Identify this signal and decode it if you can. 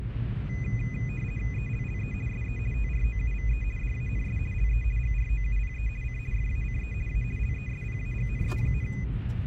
RTTY (50 baud, 450 Hz shift), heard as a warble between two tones, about 2250 Hz centre, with radio static and the noise inside a car. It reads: ELLE SE TROUVE DANS LE GROUPE C FACE A LESPAGNE,